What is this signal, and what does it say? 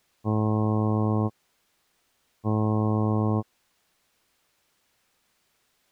Ship horn signal, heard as a ship's horn, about 110 Hz. 2 short. At sea: I am altering course to port.